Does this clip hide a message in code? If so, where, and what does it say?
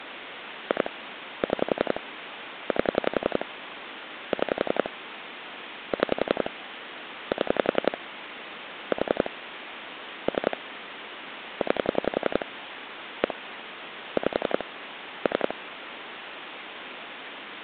Yes: pulse dialling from 0.7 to 15.5 s, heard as clicks on a phone line, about 11 pulses a second, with phone line noise. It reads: 2 6 8 6 6 7 4 3 9 1 5 3